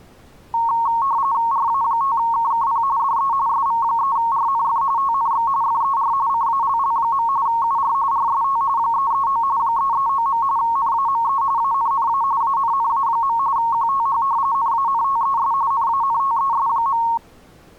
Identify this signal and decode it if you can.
RTTY (45.45 baud, 170 Hz shift), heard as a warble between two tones, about 1010 Hz centre. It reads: RA5KKP DE SV3RNF TNX FER CALL. UR RST 339 339. NAME ANNA ANNA. QTH NANTES NANTES.